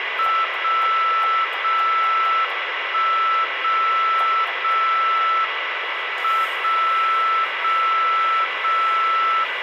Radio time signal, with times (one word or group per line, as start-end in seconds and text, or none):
0.4-1.4 0
1.4-2.4 0
2.4-3.4 1
3.4-4.4 0
4.4-5.4 0
5.4-6.4 M
6.4-7.4 0
7.4-8.4 0
8.4-9.4 0